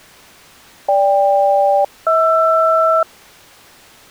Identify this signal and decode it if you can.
Aircraft SELCAL, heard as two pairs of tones. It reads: GK-HR